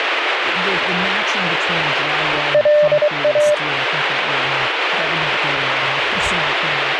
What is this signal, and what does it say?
Morse code, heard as a keyed tone, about 23 wpm, 600 Hz, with radio static and speech in English. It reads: LA